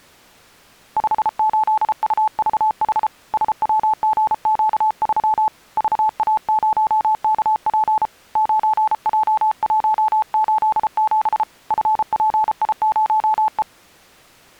Morse code, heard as a keyed tone, hand-sent with a paddle, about 33 wpm, 870 Hz. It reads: 58UVH SWGQ3 VA0KP 9J187 FPI0E